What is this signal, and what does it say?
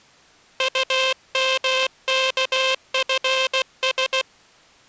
Morse code, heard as a buzzer, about 16 wpm. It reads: UMKFS